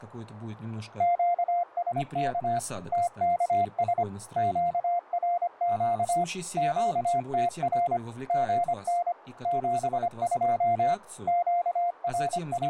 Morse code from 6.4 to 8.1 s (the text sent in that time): QTR